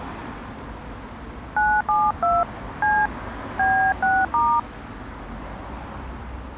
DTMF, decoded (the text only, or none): 972 C B6*